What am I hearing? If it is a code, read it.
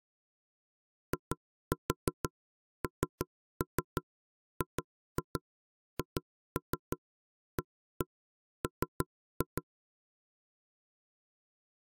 Tap code, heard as knocks on wood, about 6 knocks a second. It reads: INGHAM